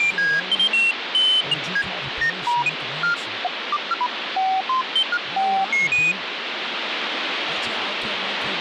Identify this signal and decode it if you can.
Electronic bleeps of random pitch and length, with radio static and speech in English. There is no code.